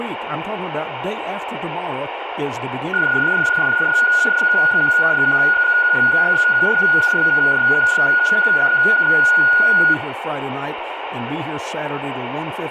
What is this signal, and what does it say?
PSK31 (31.25 baud), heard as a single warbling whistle, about 1450 Hz, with radio static and speech in English.